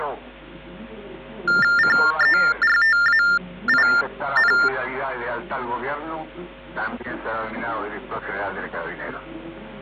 TTY/TDD text telephone tones (45.45 baud Baudot), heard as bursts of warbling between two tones, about 400 Hz shift, 1600 Hz centre. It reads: CERTAIN